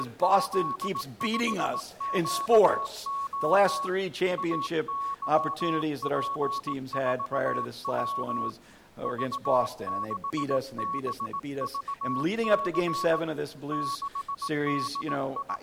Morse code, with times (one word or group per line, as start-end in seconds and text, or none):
0.0-3.9 …
4.4-8.5 AYP4W
9.1-13.2 V6BVC
13.7-15.6 …